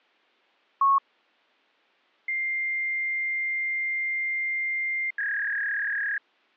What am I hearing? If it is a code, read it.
Fax machine handshake, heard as a long tone and a warble.